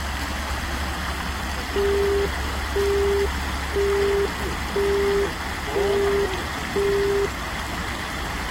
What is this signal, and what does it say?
Telephone call progress tone (single-tone plan, as in Europe, Japan and elsewhere), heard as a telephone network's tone, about 400 Hz, 0.5 s on and 0.5 s off, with the noise of a park. Busy tone.